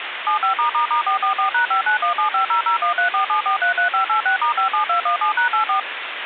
DTMF, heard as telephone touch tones, dialled by machine, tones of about 110 ms, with phone line noise. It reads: 75***444#59175001347433586*57217#84